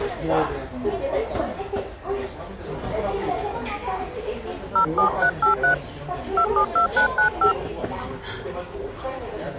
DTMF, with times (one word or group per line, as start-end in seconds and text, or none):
4.8-5.7 07383
6.4-7.5 272995